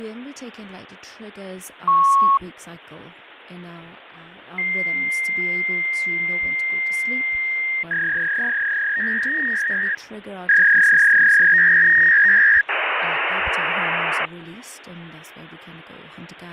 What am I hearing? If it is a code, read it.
Fax machine handshake, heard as a beep, a long tone, a warble and hiss, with phone line noise and speech in English.